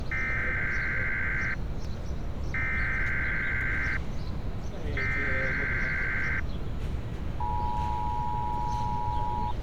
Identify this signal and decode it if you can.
Emergency Alert System (SAME) tones (header bursts, then the 853 and 960 Hz attention tone), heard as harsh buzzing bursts, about 520.83 baud, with street noise.